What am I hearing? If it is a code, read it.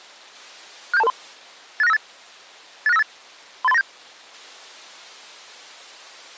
Five-tone selective call (EIA), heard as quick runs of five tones, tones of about 30 ms. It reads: 67223 86958 86958 38397